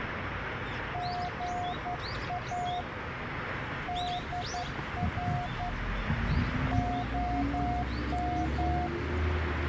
Morse code, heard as a keyed tone, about 11 wpm, 720 Hz, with radio static and the noise of a residential street. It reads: GA DR OM